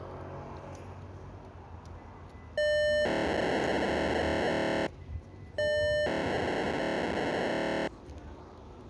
POCSAG pager data (1200 baud), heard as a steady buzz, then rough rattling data, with street noise.